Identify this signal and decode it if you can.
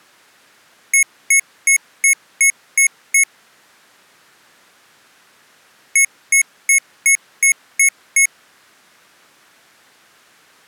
Beep code, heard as beeps from a small speaker, played twice, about 2200 Hz. 7 short. In AMI BIOS tables: virtual mode exception error; in Dell tables: processor failure.